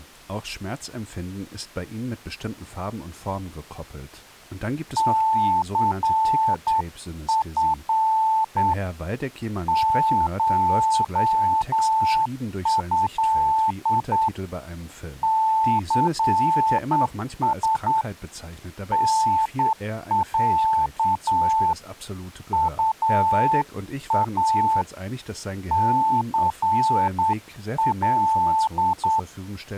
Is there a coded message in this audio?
Yes: Morse code (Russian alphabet) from 4.9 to 29.3 s, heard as a keyed tone, hand-sent with a straight key, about 9 wpm, 880 Hz, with speech in German. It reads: ЦФ ШЭ ЦС НЯ УА ЦЛ